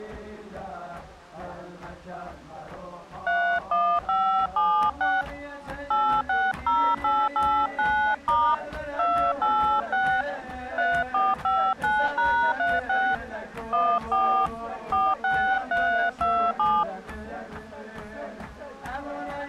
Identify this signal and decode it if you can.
DTMF, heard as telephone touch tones, dialled by hand, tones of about 290 ms. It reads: 31576 860889* 286 3459#36 14 46327